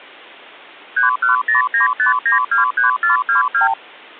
Multi-frequency trunk signalling (R2, with the far end's replies), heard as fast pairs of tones, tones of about 130 ms. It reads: 31095923422